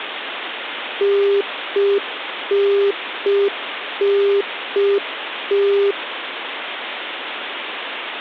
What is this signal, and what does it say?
Telephone call progress tone (UK plan), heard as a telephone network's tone, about 400 Hz, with phone line noise. Congestion tone.